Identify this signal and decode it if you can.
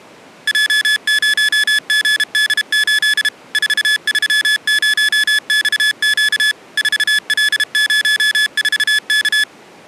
Morse code, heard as electronic beeps, machine-sent, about 32 wpm, 1700 Hz. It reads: J0GD8 430XQ 4L04K